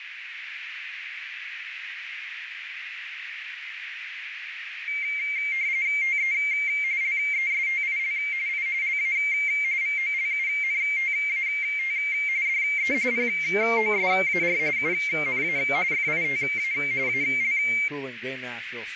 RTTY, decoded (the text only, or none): TE LESTIL I LA VOLUNTAT DE POSAR UNA FITA AL